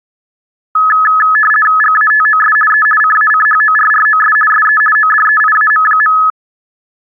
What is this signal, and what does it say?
RTTY (50 baud, 450 Hz shift), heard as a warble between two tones, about 1490 Hz centre. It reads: GATOS E CACHORROS SE ODEIAM.